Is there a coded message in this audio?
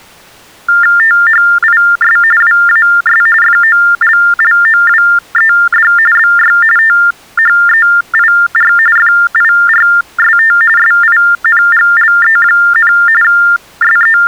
Yes: TTY/TDD text telephone tones (45.45 baud Baudot) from 0.7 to 14.3 s, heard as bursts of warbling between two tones, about 400 Hz shift, 1600 Hz centre. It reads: THIS WAS FOLLOWED BY THEIR FIRST SINGLE, …